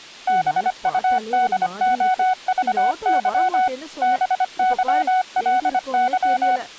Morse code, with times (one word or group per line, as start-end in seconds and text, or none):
0.3-3.7 BUDOVY
4.0-6.6 BYLY